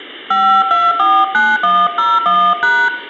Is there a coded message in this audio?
Yes: DTMF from 0.3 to 2.9 s, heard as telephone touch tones, dialled by hand, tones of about 240 ms, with room echo. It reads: 5249101#